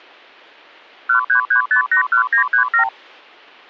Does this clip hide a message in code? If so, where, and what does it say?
Yes: multi-frequency trunk signalling (R2, with the far end's replies) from 1.1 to 2.9 s, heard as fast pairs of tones, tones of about 100 ms. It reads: 133581937